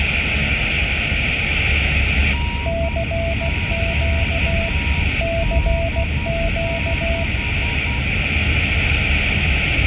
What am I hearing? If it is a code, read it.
Morse code, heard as two keyed tones, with heavy radio static and the noise inside a car. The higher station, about 10 wpm, 950 Hz: NQD6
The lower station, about 16 wpm, 670 Hz: CQ CQ